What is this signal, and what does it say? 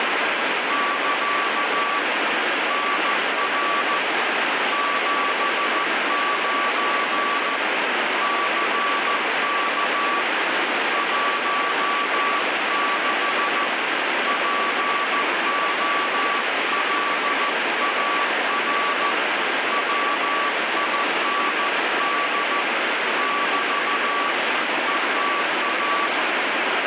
Morse code, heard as a keyed tone, hand-sent with a paddle, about 14 wpm, 1150 Hz, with heavy radio static. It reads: <KA> NR 79 CK 16 POLAR WIND <BT> ETA